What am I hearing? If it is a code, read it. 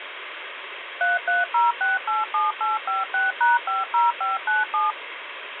DTMF, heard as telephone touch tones, dialled by machine, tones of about 170 ms, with phone line noise. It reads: 330687856#50597